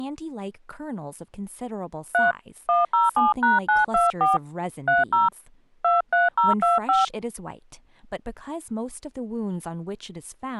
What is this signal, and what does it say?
DTMF, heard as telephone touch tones, dialled by hand, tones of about 160 ms, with speech in English. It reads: 3 107#924 30 23025